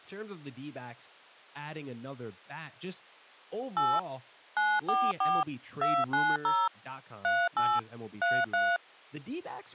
DTMF, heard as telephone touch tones, dialled by machine, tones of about 230 ms, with speech in English. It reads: 8 944 290 38 33